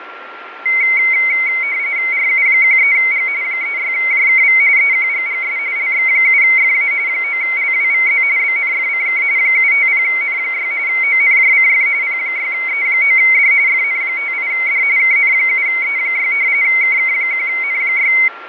RTTY (45.45 baud, 170 Hz shift), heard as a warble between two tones, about 2150 Hz centre, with radio static, fading and a steady whistle near 1370 Hz. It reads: RU13G 36JKV EQGGS LX7FA 9LWVZ BNFCK 750N6 ONJCF P6E9D FN58D KN7E6 KK1N6